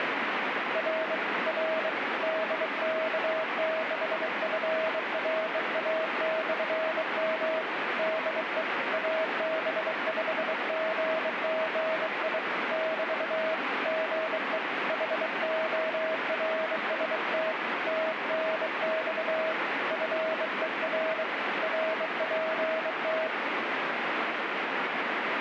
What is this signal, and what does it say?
Morse code, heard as a keyed tone, hand-sent with a bug key, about 23 wpm, 640 Hz, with radio static. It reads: R R DK6FRA/M DE AB5GGI <BT> GE HORST TNX FER RPT